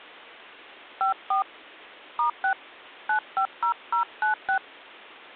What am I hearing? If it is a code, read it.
DTMF, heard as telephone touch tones, dialled by hand, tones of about 100 ms. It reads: 54 *6 950096